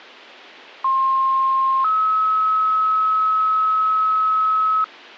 Two-tone page, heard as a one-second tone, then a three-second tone, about 1060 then 1290 Hz.